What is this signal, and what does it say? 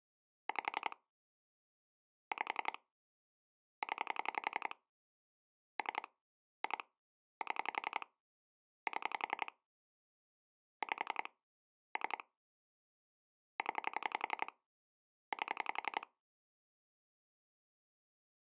Pulse dialling, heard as clicks on a phone line, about 11 pulses a second. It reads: 5 5 0 3 2 7 7 5 3 0 8